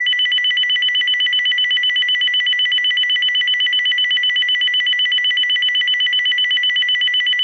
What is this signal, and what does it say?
A tone that alternates evenly between two pitches, with room echo. There is no code.